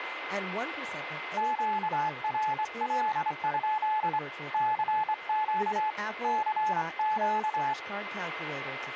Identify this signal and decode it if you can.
Morse code, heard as a keyed tone, hand-sent with a straight key, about 25 wpm, 860 Hz, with radio static, a steady whistle near 2070 Hz and speech in English. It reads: QRL? CQ CQ